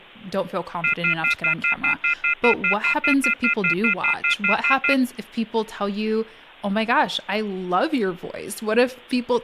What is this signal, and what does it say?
Telephone call progress tone (North American plan), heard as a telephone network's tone, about 1400, 2050, 2450, 2600 Hz, 0.1 s on and 0.1 s off, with speech in English. Off-hook warning tone.